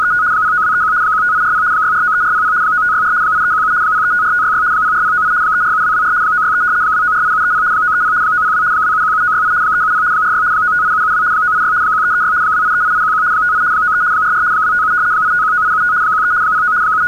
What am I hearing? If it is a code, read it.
RTTY (75 baud, 170 Hz shift), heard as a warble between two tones, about 1360 Hz centre. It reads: … 09231 15840 6493400 9564 8317 0354566 04098 347224 963 2948730 930 902 2717968 370 46 958772 986 1336 2838811 58 93 44 257 8519875 13 09 …